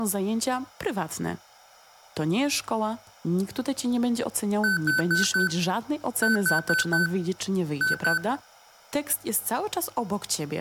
Beep code, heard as beeps from a small speaker, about 1500 Hz, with room echo and speech in Polish. 4-4-2. In Phoenix BIOS tables: parallel port failure.